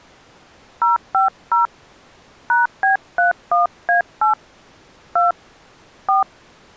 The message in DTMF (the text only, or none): 050 #B31A8 2 4